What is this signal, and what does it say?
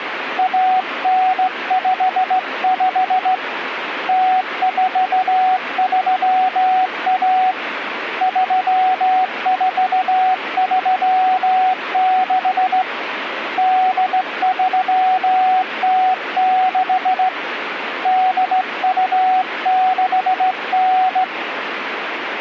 Morse code (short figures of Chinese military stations), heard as a keyed tone, hand-sent with a straight key, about 16 wpm, 750 Hz, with radio static. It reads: 1955 0431 3436 8306 8269